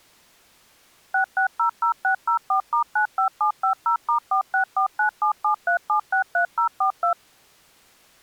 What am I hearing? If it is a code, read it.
DTMF, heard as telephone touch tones, dialled by machine, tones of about 100 ms. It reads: 6600604*95750*4649773763042